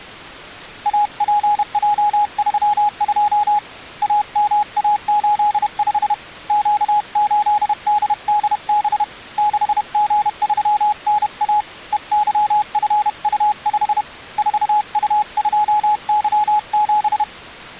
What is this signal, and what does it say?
Morse code, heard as a keyed tone, hand-sent with a paddle, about 31 wpm, 840 Hz. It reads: APJ32 AMA85 Q8DDB 6G3NA EYFU5 4U2Y7